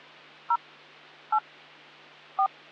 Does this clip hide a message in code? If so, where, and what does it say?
Yes: DTMF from 0.5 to 2.5 s, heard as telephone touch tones, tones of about 80 ms, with hum. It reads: 0 8 4